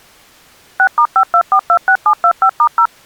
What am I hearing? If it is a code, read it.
DTMF, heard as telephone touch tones, dialled by machine, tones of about 80 ms. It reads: 6*52426725*0